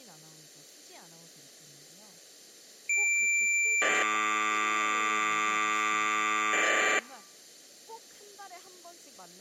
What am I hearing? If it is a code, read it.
Cassette data (Kansas City type), 1200 baud, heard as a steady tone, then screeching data, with speech in Korean.